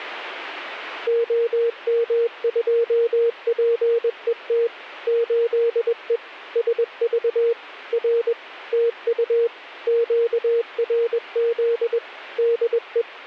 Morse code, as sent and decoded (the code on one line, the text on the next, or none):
--- -- ..--- .--. . - / ---.. . / ... ...- / .-. / - ..- / --.- .-. --.. / -.. .
OM2PET 8E SV R TU QRZ DE